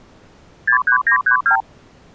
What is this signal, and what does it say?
Multi-frequency trunk signalling (R2, with the far end's replies), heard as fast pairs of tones, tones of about 100 ms. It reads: 63932